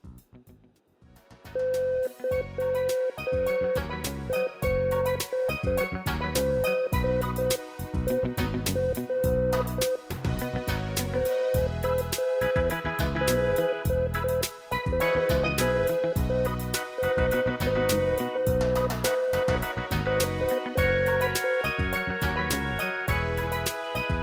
Morse code (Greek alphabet), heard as a keyed tone, machine-sent, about 7 wpm, 510 Hz, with room echo. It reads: ΥΛΔΕΡ ΚΔΓΧΦ